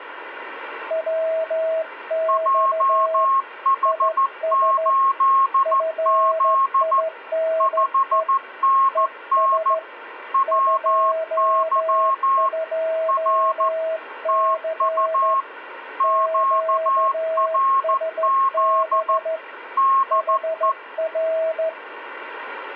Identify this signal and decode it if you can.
Morse code, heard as two keyed tones, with radio static. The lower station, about 14 wpm, 650 Hz: WX IS FINE ES 22C QSB HR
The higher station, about 14 wpm, 1080 Hz: JH8Z 5NN WY R TU QRZ DE